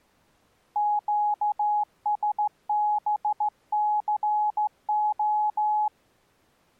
Morse code, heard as a keyed tone, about 15 wpm, 840 Hz. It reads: QSBCO